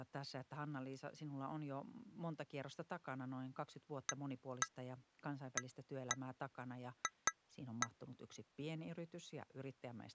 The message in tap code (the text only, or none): AAF